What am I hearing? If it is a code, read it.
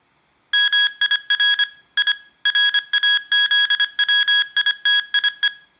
Morse code (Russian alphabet), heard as electronic beeps, machine-sent, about 25 wpm, 1650 Hz, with room echo. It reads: МИР И РАЗВИТИЕ